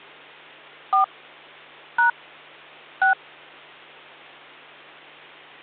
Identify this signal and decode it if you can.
DTMF, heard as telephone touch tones, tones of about 120 ms, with hum. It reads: 4 # 6